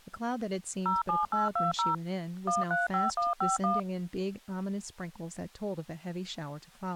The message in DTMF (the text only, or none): 07820 135151